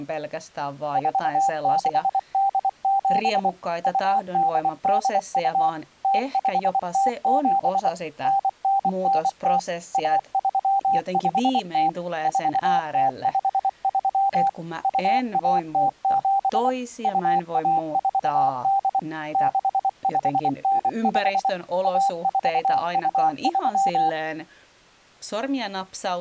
Morse code (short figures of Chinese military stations), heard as a keyed tone, machine-sent, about 24 wpm, 790 Hz, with speech in Finnish. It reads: 4687 2882 0507 9990 1350 4053 2107 2148 6595 1423